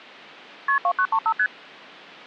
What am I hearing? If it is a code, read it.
Multi-frequency trunk signalling (R1, as on North American trunks), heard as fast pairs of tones, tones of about 70 ms. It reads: KP 2935 ST